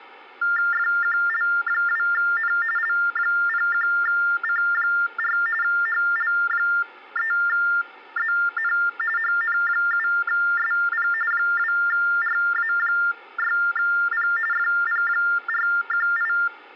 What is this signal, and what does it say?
TTY/TDD text telephone tones (45.45 baud Baudot), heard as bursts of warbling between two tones, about 400 Hz shift, 1600 Hz centre. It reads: FQL2N L01C4 HL3ZN HN7SP 2RA6P FP418